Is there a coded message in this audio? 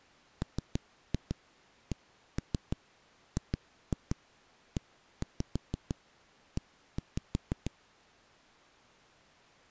Yes: tap code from 0.4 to 7.7 s, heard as knocks on a wall, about 6 knocks a second. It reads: MCGEE